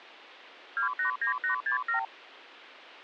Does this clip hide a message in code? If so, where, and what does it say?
Yes: multi-frequency trunk signalling (R2, with the far end's replies) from 0.8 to 2.0 s, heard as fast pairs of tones, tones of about 110 ms. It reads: 289867